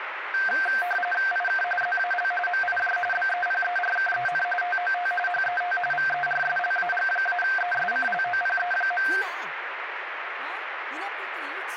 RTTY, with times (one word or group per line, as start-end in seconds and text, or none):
1.3-1.6 IK
1.8-2.3 ZAL
2.5-3.0 MIJ
3.1-4.4 BEPERKEN
4.6-5.1 TOT
5.3-5.8 HET
5.9-9.1 VERSLAG-ESCLOPE.